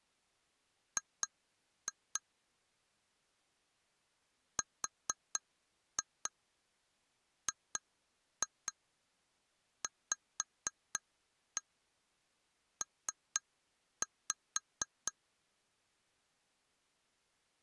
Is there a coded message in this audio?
Yes: tap code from 1.0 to 15.1 s, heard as taps on glass, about 4 knocks a second. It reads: G RGVP